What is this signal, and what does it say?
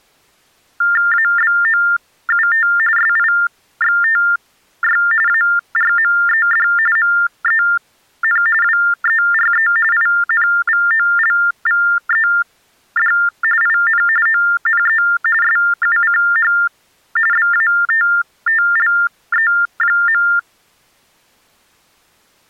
TTY/TDD text telephone tones (45.45 baud Baudot), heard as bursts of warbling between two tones, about 400 Hz shift, 1600 Hz centre. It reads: ABOUT SIXTY ARMED MEN WERE INVOLVED IN ONE SUCH BATTLE.